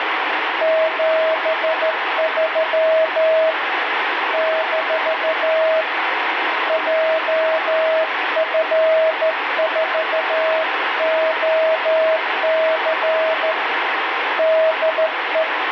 Morse code, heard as a keyed tone, hand-sent with a straight key, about 13 wpm, 640 Hz, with radio static. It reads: 73 - JF4OC DE